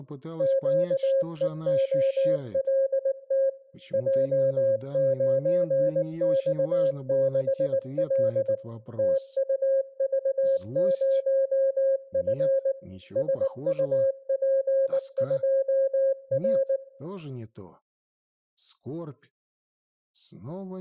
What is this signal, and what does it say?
Morse code, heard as a keyed tone, machine-sent, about 19 wpm, 540 Hz, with room echo. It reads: QEOLT J9X6L TUV0F SUP2R